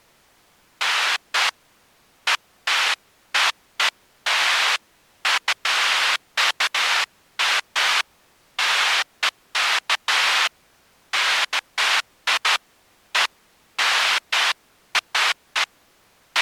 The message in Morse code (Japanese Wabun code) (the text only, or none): none